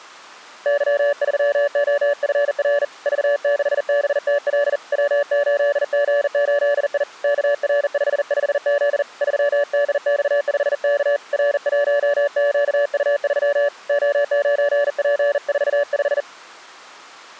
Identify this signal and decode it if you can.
Morse code, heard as a keyed tone, hand-sent with a bug key, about 40 wpm, 580 Hz. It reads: Y3OFR V6BTL W8G8I KR55Z 3DX5K R1QU3 O9P45